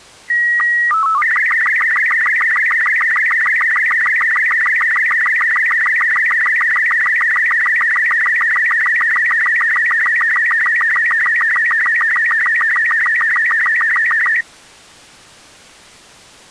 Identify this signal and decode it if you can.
SSTV (slow-scan television), Robot 36, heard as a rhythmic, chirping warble.